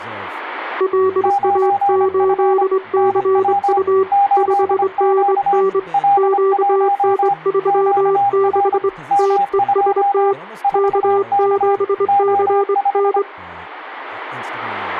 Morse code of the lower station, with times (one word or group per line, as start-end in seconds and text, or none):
0.8-4.0 LA8CU
4.4-5.8 5NN
6.2-8.9 QN36
9.2-10.3 TEST
10.8-13.2 K7CN